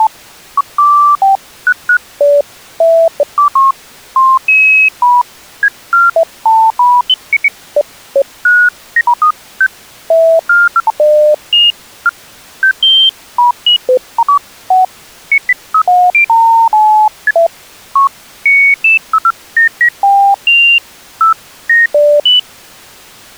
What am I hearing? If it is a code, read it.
Electronic bleeps of random pitch and length. There is no code.